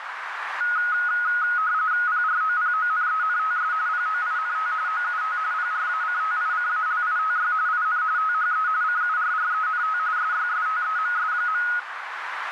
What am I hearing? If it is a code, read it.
RTTY (45.45 baud, 170 Hz shift), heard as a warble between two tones, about 1360 Hz centre, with radio static and a narrow filter. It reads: PROPONENTS POINT OUT PRACTICALITY IN THE CURRENT SYSTEMS.